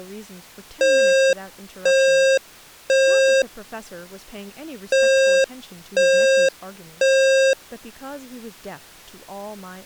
Alarm pattern, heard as an alarm's beeps, played twice, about 540 Hz, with speech in English. Temporal three. Smoke or fire, evacuate.